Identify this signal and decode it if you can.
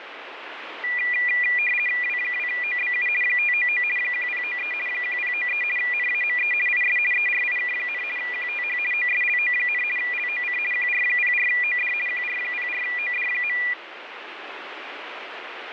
RTTY (50 baud, 450 Hz shift), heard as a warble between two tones, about 2200 Hz centre, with radio static. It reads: W2OBU 599 1093 1093 NAME IS ERIK, QTH OSLO, LOC QR04OD QR04OD.